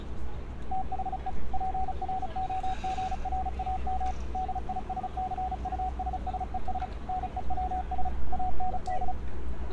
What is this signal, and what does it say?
Morse code, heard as a keyed tone, machine-sent, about 35 wpm, 750 Hz, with street noise. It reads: THE PROGRAM DISCUSSES NEWS AND